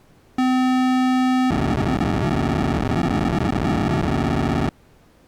POCSAG pager data (512 baud), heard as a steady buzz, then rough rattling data.